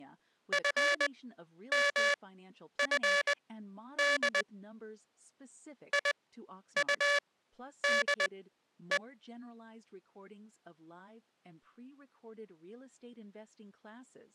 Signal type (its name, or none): Morse code